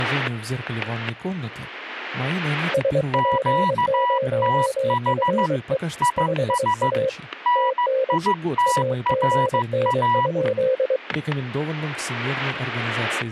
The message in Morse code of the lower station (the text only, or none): SP0FE 5A TN AGN?